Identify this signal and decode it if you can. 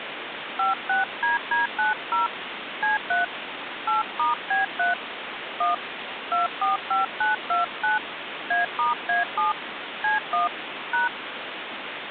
DTMF, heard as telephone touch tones, dialled by hand, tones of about 150 ms, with phone line noise. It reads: 56DD90 C3 8*B3 1 245929 A*A7 C1 #